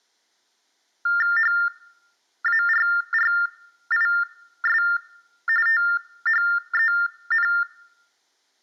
TTY/TDD text telephone tones (45.45 baud Baudot), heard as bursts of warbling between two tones, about 400 Hz shift, 1600 Hz centre. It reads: HARRIS THEN